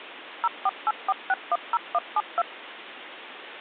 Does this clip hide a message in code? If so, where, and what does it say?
Yes: DTMF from 0.4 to 2.4 s, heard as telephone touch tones, dialled by machine, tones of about 40 ms, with phone line noise. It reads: 0484610172